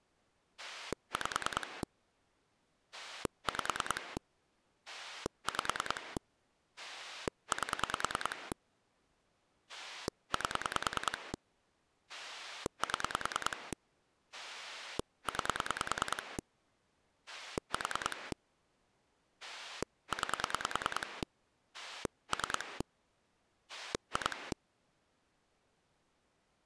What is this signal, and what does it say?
Pulse dialling, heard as a rotary dial, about 10 pulses a second. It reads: 5 5 5 8 8 7 9 4 9 3 2